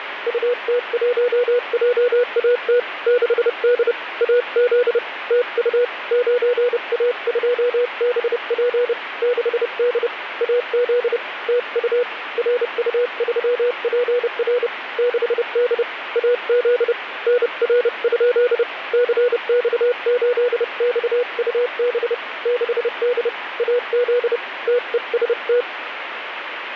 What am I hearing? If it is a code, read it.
Morse code, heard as a keyed tone, hand-sent with a paddle, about 30 wpm, 490 Hz, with radio static. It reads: UT1JAT 6D AZ TU 9A2BP 6D AZ TU RU3PR 6D AZ NR? CX8XUB 6D AZ TEST